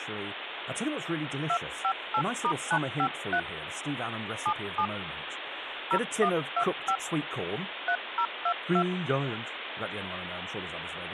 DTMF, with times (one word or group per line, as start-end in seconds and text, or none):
1.5-3.4 258*953
4.5-4.9 77
5.9-7.0 0125
7.9-8.8 3022